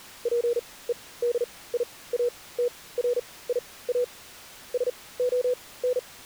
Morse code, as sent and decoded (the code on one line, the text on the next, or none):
.--. . -.. .. .- - .-. .. .- / ... --- -.
PEDIATRIA SON